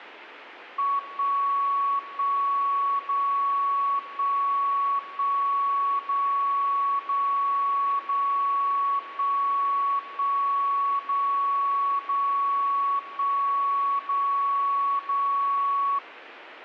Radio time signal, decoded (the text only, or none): 1 1 0 1 1 0 0 0 1 1 0 0 1 0 0